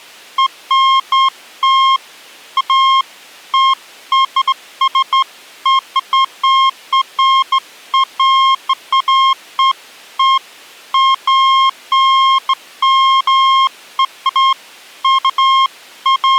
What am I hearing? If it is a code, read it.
Beeps of irregular length. There is no code.